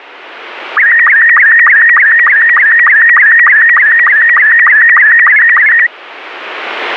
SSTV (slow-scan television), Robot 72, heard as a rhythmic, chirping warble.